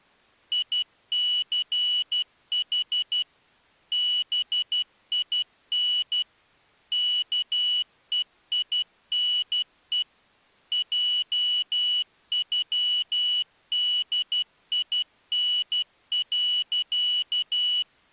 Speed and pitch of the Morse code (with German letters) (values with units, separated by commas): 12 wpm, 2950 Hz